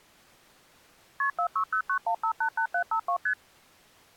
Multi-frequency trunk signalling (R1, as on North American trunks), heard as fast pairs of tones, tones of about 80 ms. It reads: KP 46091588752 ST